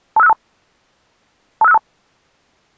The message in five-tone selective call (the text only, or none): 25652 25652